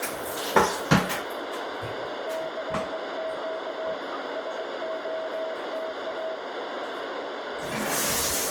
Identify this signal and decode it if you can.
Morse code, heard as a keyed tone, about 21 wpm, 640 Hz, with heavy radio static and a narrow filter. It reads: CQ SOTA